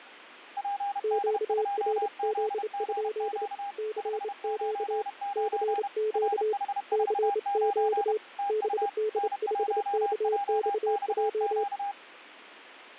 Morse code, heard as two keyed tones. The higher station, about 31 wpm, 800 Hz: PD2ZGQ 599 RH49 TU N1JXQ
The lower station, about 28 wpm, 430 Hz: QRZ? CQ CQ CQ BD5KXJ